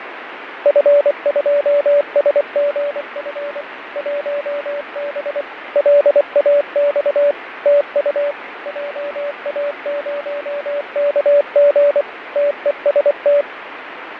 Morse code, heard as a keyed tone, machine-sent, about 24 wpm, 580 Hz, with radio static and fading. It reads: F2SGF 1B LAX TU JA0KG TEST